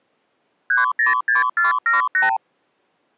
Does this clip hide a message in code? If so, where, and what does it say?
Yes: multi-frequency trunk signalling (R2, with the far end's replies) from 0.7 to 2.4 s, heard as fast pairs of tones, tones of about 140 ms. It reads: 306478